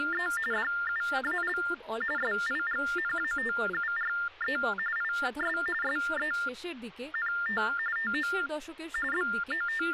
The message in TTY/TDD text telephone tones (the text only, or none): … DUAL SIGNATURE IS SENT TO …